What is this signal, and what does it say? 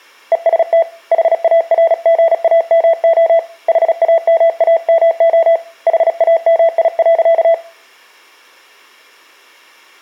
Morse code, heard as a keyed tone, hand-sent with a paddle, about 36 wpm, 660 Hz. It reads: EST HARGAMO HAMAMO HAMI.